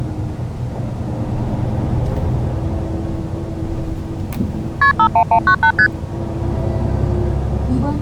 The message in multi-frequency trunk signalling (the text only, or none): KP 51198 ST